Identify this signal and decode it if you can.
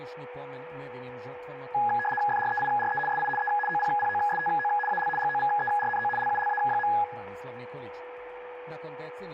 RTTY (75 baud, 850 Hz shift), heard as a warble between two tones, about 1250 Hz centre, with radio static, a steady whistle near 490 Hz and room echo. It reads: FREIRE SI E OPPOSTO AL GOVERNO LULA.